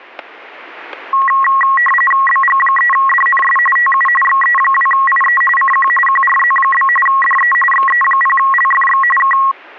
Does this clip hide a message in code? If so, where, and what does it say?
Yes: RTTY (45.45 baud, 850 Hz shift) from 1.1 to 9.5 s, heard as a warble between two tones, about 1500 Hz centre, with static crashes. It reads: BG3DNS TU XE2IE CQ QRZ? DE XE0LFX K